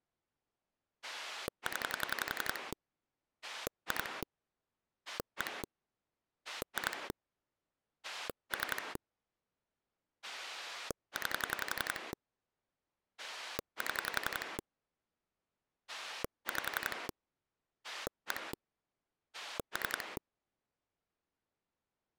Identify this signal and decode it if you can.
Pulse dialling, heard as a rotary dial, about 11 pulses a second. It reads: 0 2 1 2 3 9 7 5 1 3